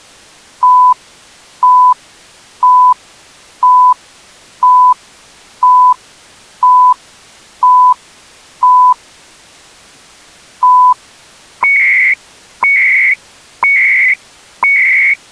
Radio time signal (CHU, Canada), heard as beeps and data bursts, one a second.